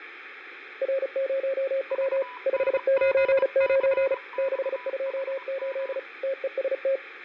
Morse code, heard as two keyed tones, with radio static and fading. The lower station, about 35 wpm, 540 Hz: R0W 599 628 TEST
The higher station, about 23 wpm, 990 Hz: VNGCXHM